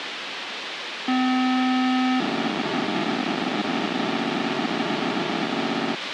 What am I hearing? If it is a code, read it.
POCSAG pager data (512 baud), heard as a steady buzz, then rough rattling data, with radio hiss and a squelch burst at the end.